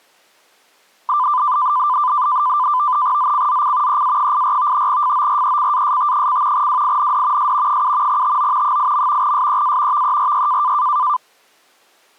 NAVTEX (SITOR-B), 100 baud, 170 Hz shift, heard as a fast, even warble, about 1100 Hz centre. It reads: ZCZC EA84 FORECAST: WIND S 7 TO 8. SEA VERY